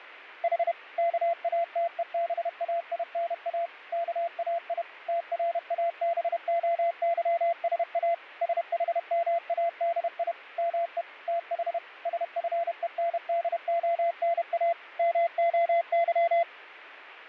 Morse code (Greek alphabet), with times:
0.4-0.7 Η
1.0-3.7 ΚΑΤΕΒΑΙΝΑ
3.9-4.8 ΚΑΙ
5.1-8.1 ΤΡΑΒΟΥΣΑ
8.4-10.3 ΣΗΜΑΔΙ
10.6-11.0 ΜΕ
11.3-11.8 ΤΗ
12.1-14.7 ΣΦΕΝΔΟΝΑ
15.0-16.4 ΜΟΥ

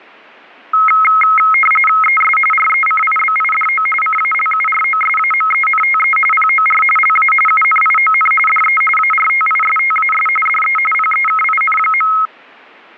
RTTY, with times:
2.0-2.4 ES
2.5-3.9 RECIBIDO
4.0-6.2 CALUROSAMENTE
6.3-6.8 POR
7.0-7.3 LA
7.5-8.3 UNION
8.5-8.8 DE
9.0-10.3 ARTISTAS
10.5-10.8 DE
10.9-12.1 PEKIN.

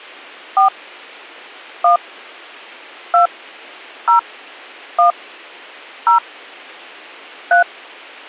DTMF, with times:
0.6-0.7 4
1.8-2.0 1
3.1-3.3 2
4.1-4.2 0
5.0-5.1 1
6.1-6.2 0
7.5-7.6 3

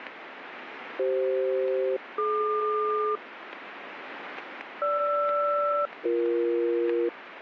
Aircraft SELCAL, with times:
1.0-3.2 CF-DQ
4.8-7.1 GR-BE

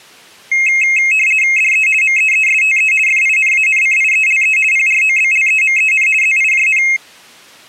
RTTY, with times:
1.6-1.9 DE
2.0-2.9 MEESTE
3.1-4.6 FINANCIELE
4.7-6.1 PROBLEMEN
6.2-6.8 ZIJN

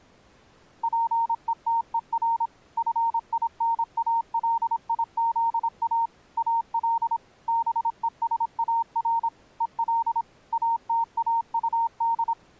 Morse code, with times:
0.8-2.5 PETER
2.8-6.1 FINALIZA
6.4-7.2 AL
7.5-9.3 BESAR
9.6-10.2 EL
10.5-12.3 ATAUD

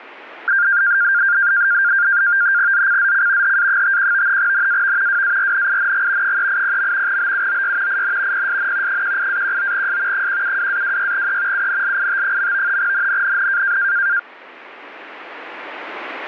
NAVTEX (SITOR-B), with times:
2.7-3.6 ZCZC
3.4-4.4 HA51
4.4-5.2 NAV
5.1-6.4 WARNING
6.2-7.2 380.
7.1-8.0 BUOY
7.9-8.5 IN
8.3-9.0 PSN
8.9-10.3 18-19S
10.1-11.7 172-26E
11.5-12.8 UNLIT.
12.8-13.8 NNNN

